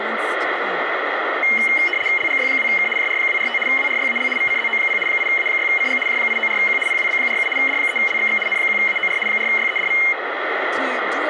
RTTY (75 baud, 850 Hz shift), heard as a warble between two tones, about 2550 Hz centre, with radio static. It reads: LGY2K JR245 WRYAL VCZO0 8A6CG J894Q PWB47 D3LXX N1AOR 4YEDV